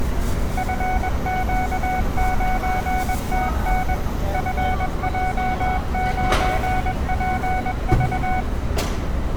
Morse code, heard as a keyed tone, machine-sent, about 21 wpm, 740 Hz, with room echo and street noise. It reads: FQ9TN FJ9PV